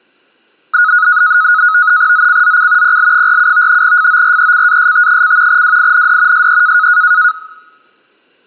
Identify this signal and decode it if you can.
NAVTEX (SITOR-B), 100 baud, 170 Hz shift, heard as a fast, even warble, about 1360 Hz centre. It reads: ZCZC PL47 FORECAST: WIND SE